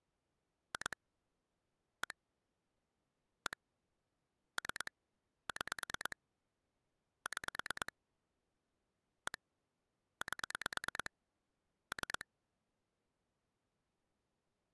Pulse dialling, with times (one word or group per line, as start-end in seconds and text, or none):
0.7-1.0 2
2.0-2.1 1
3.5-3.6 1
4.6-4.9 3
5.5-6.2 6
7.3-7.9 6
9.3-9.4 1
10.2-11.1 8
11.9-12.3 3